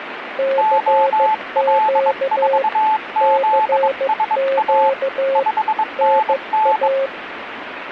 Morse code, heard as two keyed tones, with radio static. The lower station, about 15 wpm, 540 Hz: CQ CQ NA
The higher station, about 22 wpm, 870 Hz: OL4ZSA 5NN